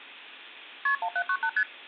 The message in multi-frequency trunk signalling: KP 1798 ST

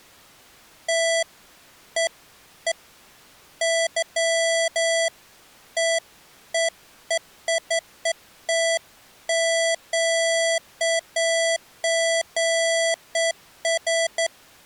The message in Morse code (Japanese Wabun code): none

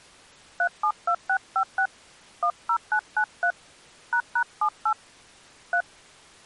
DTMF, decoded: 372656 10993 ##78 3

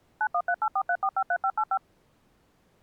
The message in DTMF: 913843453585

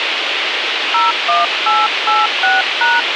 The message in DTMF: 01886#

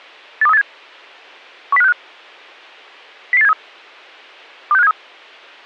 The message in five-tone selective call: 82387 10565 00873 26573

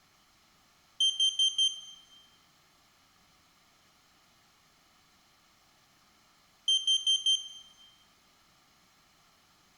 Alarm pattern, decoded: temporal four

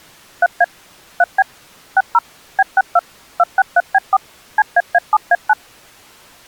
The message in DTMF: 3A 3B 60 B62 263B4 CAA7A9

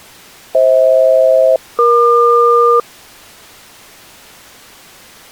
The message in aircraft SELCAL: FH-EQ

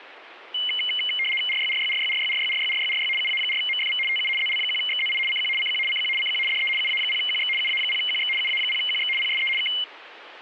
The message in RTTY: RYRYRYRYRYRYRYRY UA4MFV TU ZL1XZI CQ CQ CQ CQ DE UA0QX UA0QX UA0QX PSE K

